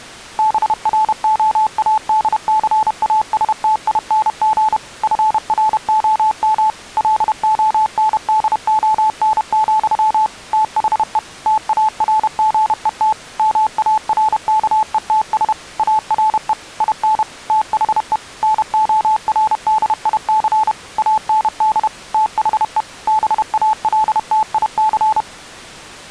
Morse code, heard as a keyed tone, machine-sent, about 31 wpm, 870 Hz. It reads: BROADCASTING FROM LONDON, THE TARGET MARKETS ARE IN THE NORDIC AND THE BALTIC